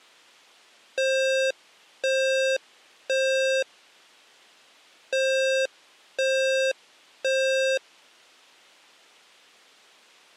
Alarm pattern, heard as an alarm's beeps, played twice, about 530 Hz. Temporal three. Smoke or fire, evacuate.